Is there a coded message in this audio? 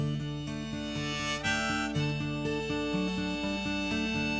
No.